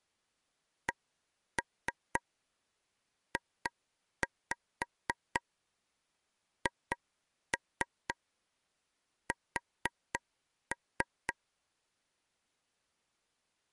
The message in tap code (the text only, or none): CJHS